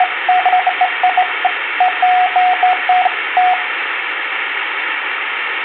Beeps of irregular length, with phone line noise and room echo. There is no code.